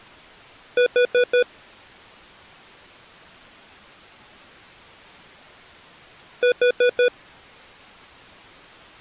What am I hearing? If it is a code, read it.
Alarm pattern, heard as an alarm's beeps, played twice, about 490 Hz. Temporal four. Carbon monoxide.